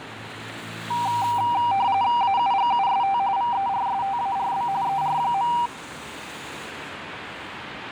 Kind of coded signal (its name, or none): RTTY